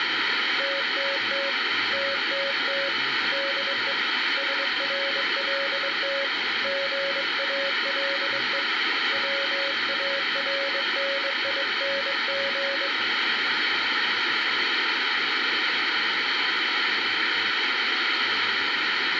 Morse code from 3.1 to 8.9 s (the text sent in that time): DE SRLT GALE